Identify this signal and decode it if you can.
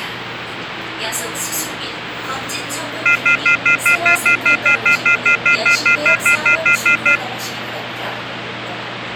Telephone call progress tone (North American plan), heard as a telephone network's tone, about 1400, 2050, 2450, 2600 Hz, 0.1 s on and 0.1 s off, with phone line noise and the noise inside a subway train. Off-hook warning tone.